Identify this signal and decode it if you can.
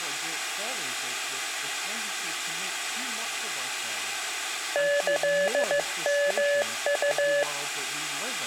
Morse code (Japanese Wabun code), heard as a keyed tone, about 15 wpm, 570 Hz, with room echo. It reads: キヨウ